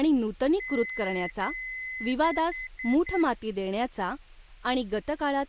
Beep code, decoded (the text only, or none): 2 long, 4 short